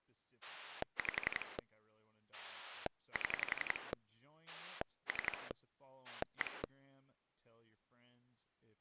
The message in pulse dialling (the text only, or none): 5 7 3 1